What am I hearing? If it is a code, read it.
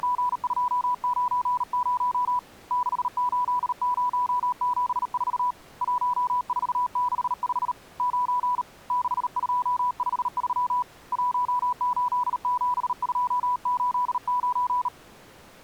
Morse code, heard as a keyed tone, hand-sent with a bug key, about 38 wpm, 990 Hz. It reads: … 68074 1465 9 6253 187289